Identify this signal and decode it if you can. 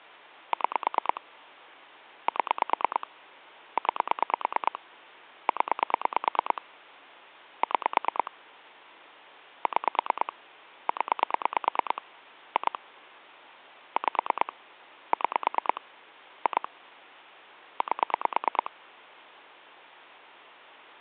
Pulse dialling, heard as clicks on a phone line, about 9 pulses a second, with hum. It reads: 6 7 9 0 6 6 0 2 5 6 2 8